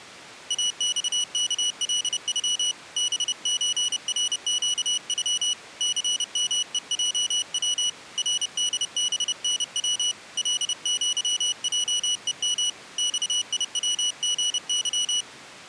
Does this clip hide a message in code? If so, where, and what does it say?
Yes: Morse code (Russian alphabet) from 0.4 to 15.3 s, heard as a high beeper, hand-sent with a paddle, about 30 wpm, 2950 Hz. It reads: АЬКЛЮ БЧРЩЮ ЦМЕЙВ РДБНВ ЛЪЙЕМ ЬИВГЫ